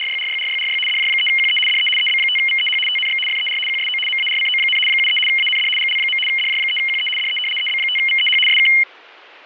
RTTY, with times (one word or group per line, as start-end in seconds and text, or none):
0.0-0.8 …
0.9-1.6 DJ3QE
1.7-1.9 DE
2.0-2.8 EB5VEH
2.9-3.2 TNX
3.3-3.6 FER
3.7-4.0 QSO
4.1-4.8 MARCO,
4.9-5.2 73
5.3-5.7 AND
5.8-6.2 GL.
6.3-7.1 DJ3QE
7.2-7.4 DE
7.6-8.4 EB5VEH
8.5-8.7 SK